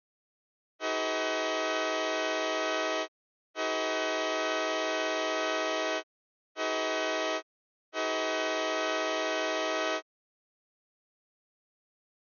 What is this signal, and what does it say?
Train horn signal, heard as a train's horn. 2 long, 1 short, 1 long. On North American railways: approaching a public crossing.